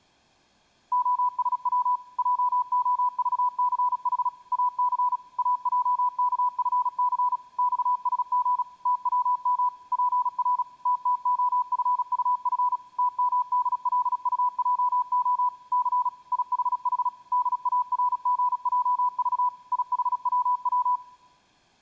Morse code, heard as a keyed tone, machine-sent, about 36 wpm, 990 Hz. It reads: OSW JOVCH AC AJKFC XSG TWM PR TTOFUF TMDLUJO C IHH DARGJV IHWW